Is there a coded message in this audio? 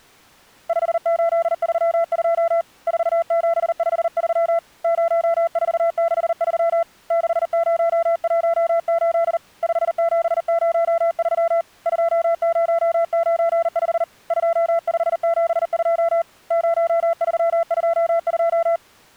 Yes: Morse code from 0.6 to 18.8 s, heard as a keyed tone, hand-sent with a paddle, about 39 wpm, 670 Hz. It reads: 5832 4753 0463 6018 5703 2095 2572 0322